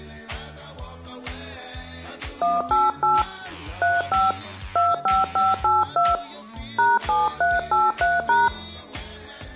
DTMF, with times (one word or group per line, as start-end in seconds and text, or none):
2.4-3.2 188
3.8-4.3 35
4.8-6.1 25582
6.8-8.5 #7383#